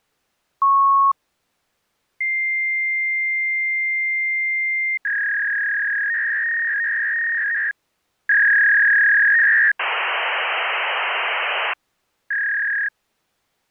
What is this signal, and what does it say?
Fax machine handshake, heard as a beep, a long tone, a warble and hiss.